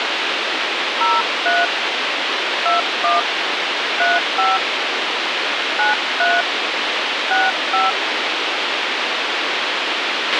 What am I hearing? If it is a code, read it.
DTMF, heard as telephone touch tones, dialled by hand, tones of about 180 ms, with radio hiss and a squelch burst at the end. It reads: 03 21 35 93 65